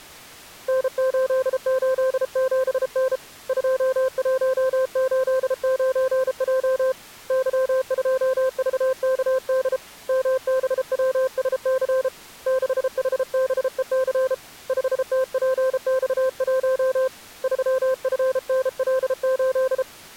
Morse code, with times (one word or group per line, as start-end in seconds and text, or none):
0.7-3.2 N887N
3.5-6.9 2189J
7.3-9.8 Y2VKD
10.1-12.1 MBWSC
12.5-14.3 6HBEC
14.7-17.1 5TPX1
17.4-19.8 3FNL8